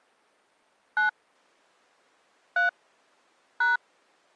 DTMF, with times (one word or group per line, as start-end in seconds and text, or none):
1.0-1.1 9
2.6-2.7 3
3.6-3.8 #